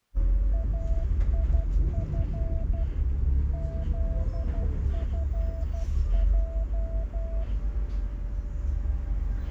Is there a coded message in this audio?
Yes: Morse code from 0.5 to 7.5 s, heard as a keyed tone, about 12 wpm, 660 Hz, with the noise inside a bus. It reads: AIF ZFJ